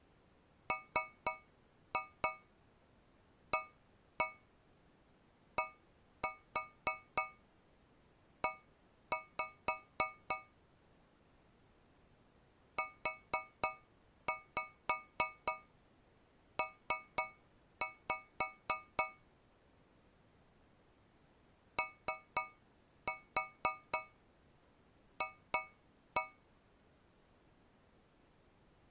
Tap code, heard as taps on a metal pipe, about 3 knocks a second. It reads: MADE UP OF